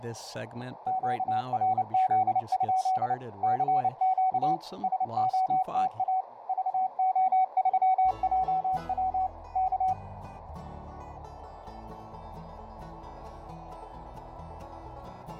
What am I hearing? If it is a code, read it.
Morse code, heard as a keyed tone, machine-sent, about 29 wpm, 750 Hz, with radio static and a narrow filter. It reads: QRZ? CQ SOTA VO3JW K